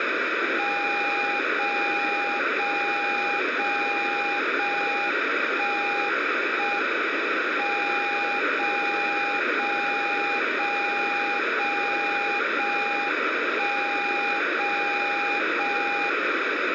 Radio time signal (JJY), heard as a tone whose level steps once a second, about 810 Hz, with radio static and room echo. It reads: 0 0 0 0 1 1 M 0 0 0 0 0 1 0 0 1